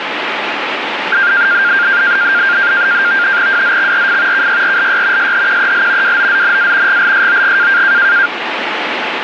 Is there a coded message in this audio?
Yes: NAVTEX (SITOR-B), 100 baud, 170 Hz shift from 1.1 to 8.3 s, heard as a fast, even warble, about 1500 Hz centre, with radio static. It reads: WZXRF KYRLY SHQEL WOZNA GLSOG